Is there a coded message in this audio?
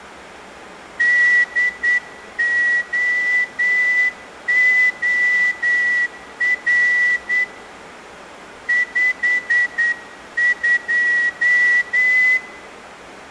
Yes: Morse code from 0.9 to 12.4 s, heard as a whistle, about 9 wpm. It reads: DOOR 52